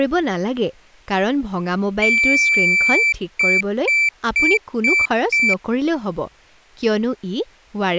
Beep code, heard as a piezo beeper, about 2350 Hz, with speech in Assamese. 1 long, 5 short.